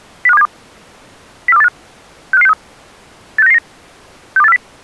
Five-tone selective call (EEA), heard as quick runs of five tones, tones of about 40 ms. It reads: 05272 04285 65563 86999 62840